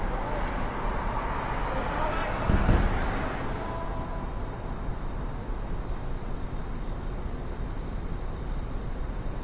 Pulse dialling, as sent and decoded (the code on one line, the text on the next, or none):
none